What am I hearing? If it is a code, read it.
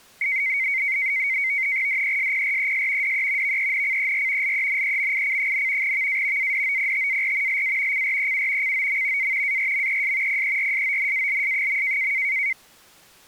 NAVTEX (SITOR-B), 100 baud, 170 Hz shift, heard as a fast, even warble, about 2150 Hz centre. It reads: DESPRES DE VENCER LENEMIC, VA ADOPTAR LA CREU COM A ARMES PERSONALS.